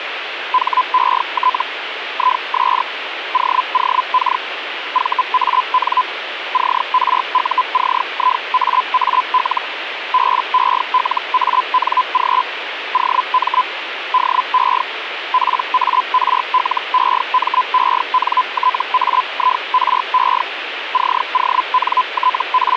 Hellschreiber (Feld-Hell, 122.5 baud), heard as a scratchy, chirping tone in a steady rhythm, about 1010 Hz, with radio static. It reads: HET IS OOK VAN CRUCIAAL BELANG OM DE PARLEMENTAIRE …